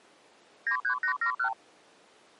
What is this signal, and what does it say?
Multi-frequency trunk signalling (R2, with the far end's replies), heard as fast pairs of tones, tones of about 90 ms. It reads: 93871